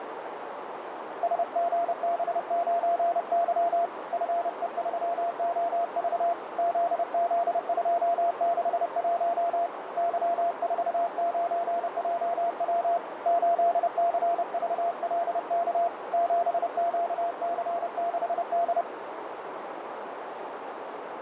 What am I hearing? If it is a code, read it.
Morse code, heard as a keyed tone, hand-sent with a paddle, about 30 wpm, 690 Hz, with radio static and a narrow filter. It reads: SGB9Y FE3OV ZZ261 Y49JW 8CVLK 7QC6D